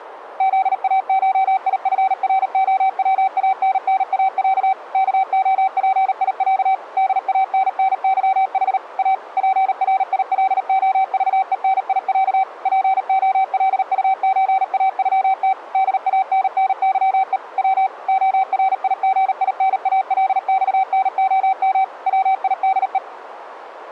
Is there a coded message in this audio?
Yes: Morse code (Russian alphabet) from 0.3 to 23.0 s, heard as a keyed tone, machine-sent, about 38 wpm, 770 Hz. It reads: ЗАШИФРОВАННАЯ КОПИЯ ДАННЫХ А ПРИЛОЖЕНИЯ ПОЛУЧАЮТ ДАННЫЕ В ОРИГИНАЛЬНОМ ВИДЕ